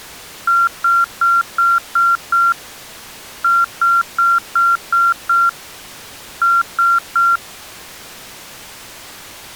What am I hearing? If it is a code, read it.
Beep code, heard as beeps, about 1380 Hz. 6-6-3.